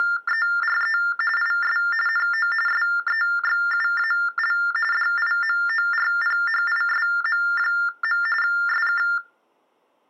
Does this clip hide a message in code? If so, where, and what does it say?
Yes: TTY/TDD text telephone tones (45.45 baud Baudot) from 0.0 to 9.2 s, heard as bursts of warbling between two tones, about 400 Hz shift, 1600 Hz centre. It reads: … IS NO SEXUAL DIMORPHISM. SK